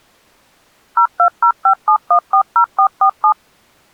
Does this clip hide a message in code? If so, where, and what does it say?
Yes: DTMF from 1.0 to 3.3 s, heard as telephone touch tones, dialled by machine, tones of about 80 ms. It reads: 02057140447